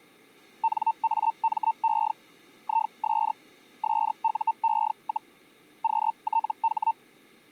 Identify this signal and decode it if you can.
Hellschreiber (Feld-Hell, 122.5 baud), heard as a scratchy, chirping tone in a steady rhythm, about 900 Hz. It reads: NAME IS SUE, QTH